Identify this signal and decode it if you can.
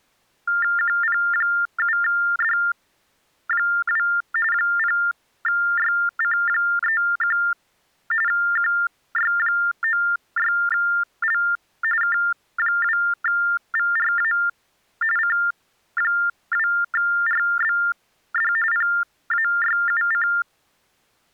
TTY/TDD text telephone tones (45.45 baud Baudot), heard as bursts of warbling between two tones, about 400 Hz shift, 1600 Hz centre. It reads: QP7D2 0YC31 QY96L K2VRA C2RBD PAYUC